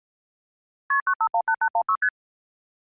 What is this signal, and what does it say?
Multi-frequency trunk signalling (R1, as on North American trunks), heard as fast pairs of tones, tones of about 70 ms. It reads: KP 9518816 ST